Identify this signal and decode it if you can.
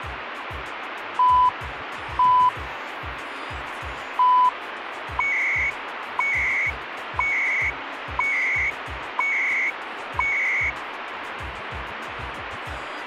Radio time signal (CHU, Canada), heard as beeps and data bursts, one a second, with radio static.